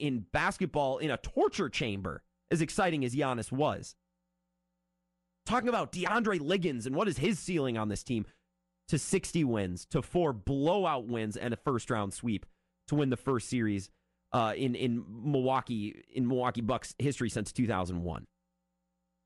Speech in English. There is no code.